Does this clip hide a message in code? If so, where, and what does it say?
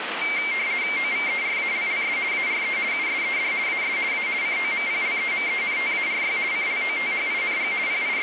Yes: RTTY (50 baud, 170 Hz shift) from 0.2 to 8.2 s, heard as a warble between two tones, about 2200 Hz centre, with radio static. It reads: OVERALLS ARE USED AS A COMPLEMENTARY CLOTHING …